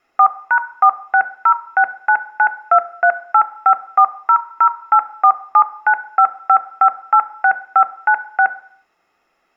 DTMF, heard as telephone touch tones, dialled by machine, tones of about 70 ms, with room echo. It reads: 4#4606992385400847955586596